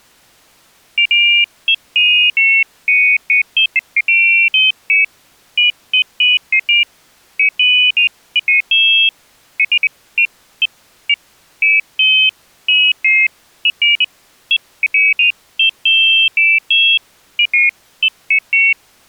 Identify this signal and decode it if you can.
Pairs of high tones at irregular times. There is no code.